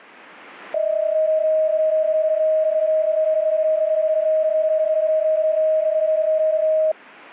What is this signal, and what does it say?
PSK31 (31.25 baud), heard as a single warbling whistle, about 630 Hz.